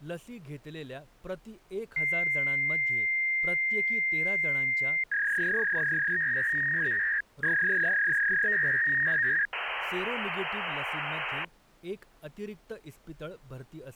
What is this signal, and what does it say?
Fax machine handshake, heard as a long tone, a warble and hiss, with speech in Marathi.